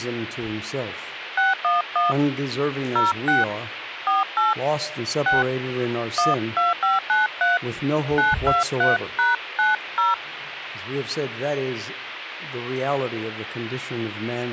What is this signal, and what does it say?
DTMF, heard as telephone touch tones, dialled by hand, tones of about 160 ms, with radio hiss and a squelch burst at the end. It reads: 611 06 48 6 12593 923#90